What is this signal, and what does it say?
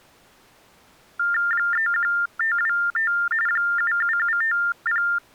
TTY/TDD text telephone tones (45.45 baud Baudot), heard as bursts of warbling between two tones, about 400 Hz shift, 1600 Hz centre. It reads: 31525 77750